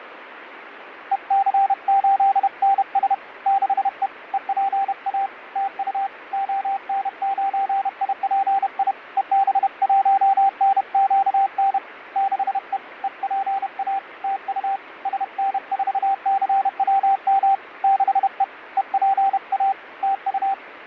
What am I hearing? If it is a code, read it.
Morse code, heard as a keyed tone, hand-sent with a paddle, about 31 wpm, 780 Hz, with radio static. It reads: EC8NS 6E EPA TU ON9IPI EB1NQN 6E EPA TU SN4CWM 6E EPA TU